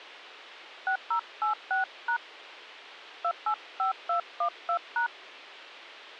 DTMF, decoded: 6086# 285212#

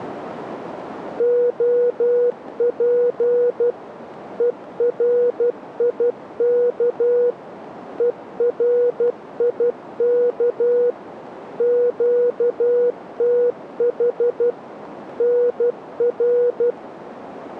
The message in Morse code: OP ERIK ERIK QTH NR

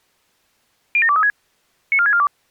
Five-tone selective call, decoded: 07236 94642

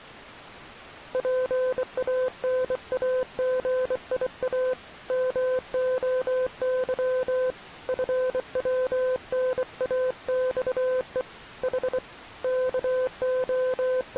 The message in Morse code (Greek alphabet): ΠΑΝΑΓΙΑ ΜΟΥ ΦΩΝΑΞΕ Η …

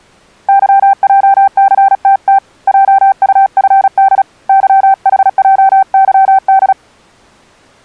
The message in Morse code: YJCTT JUFD YHJYD

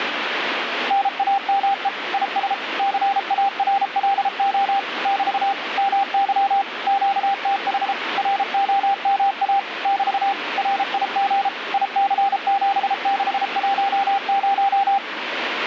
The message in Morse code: NAME IS CARLO <BT> MY QTH ROMA <BT> RIG IC7610

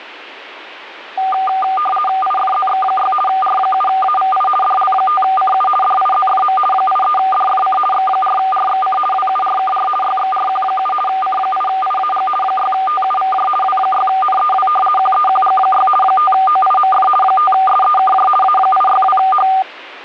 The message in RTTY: IFZX6 R7AVI DL5CU DIZFM 83DFC X4RXC WURKR YXRQ7 C8IAG 6TUVJ W6NEW QEQG6 5OIMF 5SEKJ A862H

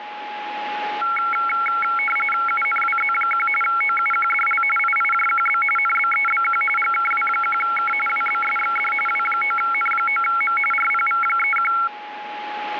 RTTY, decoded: UNWZ1 OUQDL IIJQB NBEBQ GKW1K WBSXD W9N9M RPV31

